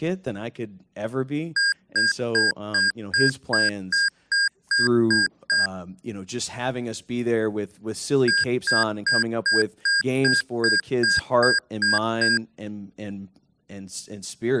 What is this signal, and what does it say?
Beep code, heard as beeps from a small speaker, played twice, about 1600 Hz, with speech in English. 11 short. In AMI BIOS tables: cache memory error.